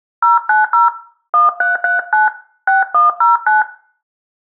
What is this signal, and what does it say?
DTMF, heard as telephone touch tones, dialled by hand, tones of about 150 ms, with room echo. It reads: 090 1339 6109